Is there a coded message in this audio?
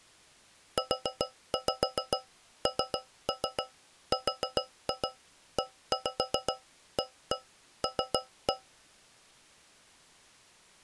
Yes: tap code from 0.8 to 8.7 s, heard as taps on a metal pipe, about 7 knocks a second. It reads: UNREAL